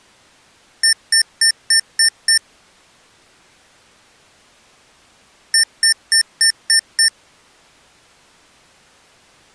Beep code, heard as beeps from a small speaker, played twice, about 1800 Hz. 6 short. In AMI BIOS tables: keyboard controller gate A20 failure; in Dell tables: video card failure.